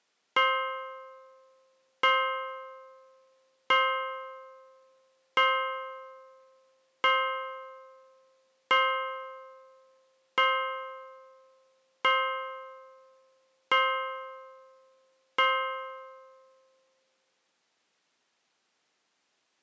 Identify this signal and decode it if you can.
Clock strike, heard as a bell. 10. Ten o'clock.